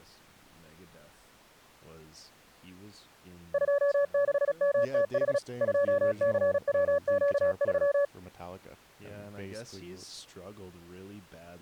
Morse code, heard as a keyed tone, machine-sent, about 36 wpm, 570 Hz, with speech in English. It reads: 26MTH 2CWQ3